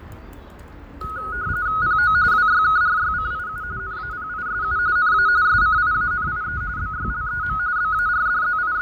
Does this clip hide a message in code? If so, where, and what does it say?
Yes: RTTY (45.45 baud, 170 Hz shift) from 1.0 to 8.8 s, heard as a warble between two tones, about 1360 Hz centre, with fading and the noise of a residential street. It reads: PO WYKRYCIU NAPISU NA SCIANIE BYLEM …